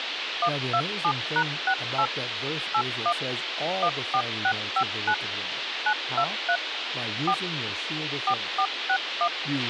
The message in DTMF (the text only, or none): 127#68 81 14659 923 4 4461